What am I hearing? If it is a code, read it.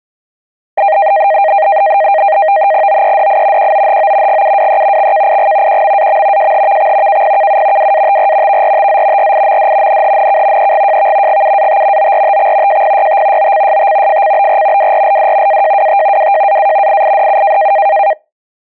NAVTEX (SITOR-B), 100 baud, 170 Hz shift, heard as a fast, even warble, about 710 Hz centre. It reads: OEDI QOHO GUWE XKIG QMAM JHVX KPKU WATR VRTZ RIMD NHNK EGJV GUAT ORTX JPYT OCST FCBR WRLD AJWT WJAA IIDU